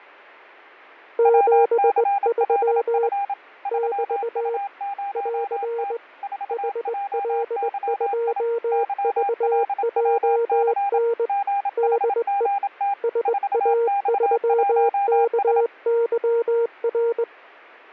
Morse code, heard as two keyed tones, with fading. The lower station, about 20 wpm, 470 Hz: 73 <BT> <AR> HL2VJN DE SA3KYR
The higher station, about 27 wpm, 800 Hz: WCLF 3U0T 4JYI YLWC GHGT 4X1S